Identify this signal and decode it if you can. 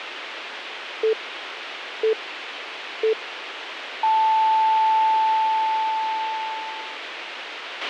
Radio time signal (three low pips and a long one an octave up, as on NHK), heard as pips, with radio hiss and a squelch burst at the end.